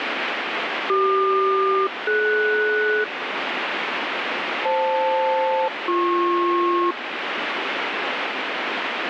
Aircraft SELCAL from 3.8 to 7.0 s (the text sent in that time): FL-BP